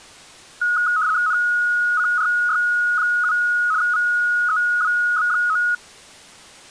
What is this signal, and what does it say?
RTTY (75 baud, 170 Hz shift), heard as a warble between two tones, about 1360 Hz centre. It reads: NCRY7 VEWB9